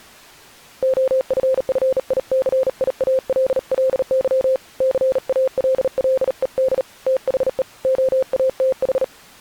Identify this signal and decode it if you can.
Morse code, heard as a keyed tone, hand-sent with a bug key, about 38 wpm, 520 Hz. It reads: OFFICIALLY CALLED THE OATH